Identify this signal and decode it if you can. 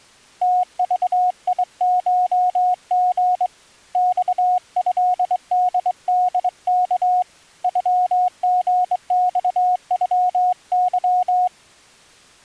Morse code (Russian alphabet), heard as a keyed tone, hand-sent with a straight key, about 23 wpm, 730 Hz. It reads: ТЖИШГ ЬЭДДК ЮГЬЮЫ